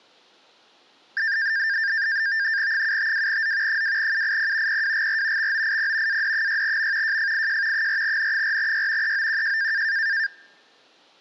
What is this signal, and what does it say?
NAVTEX (SITOR-B), 100 baud, 170 Hz shift, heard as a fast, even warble, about 1700 Hz centre. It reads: 752Z 2UIP PWGR XOIP AD6M JFIJ 4N4Y EOQJ